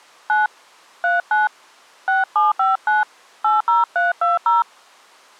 DTMF, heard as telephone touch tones, dialled by hand, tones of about 160 ms. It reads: 9 39 6759 80320